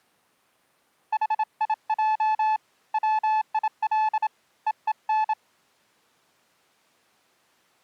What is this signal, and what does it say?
Morse code, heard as a keyed tone, hand-sent with a bug key, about 27 wpm, 870 Hz. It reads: HIJ WIL EEN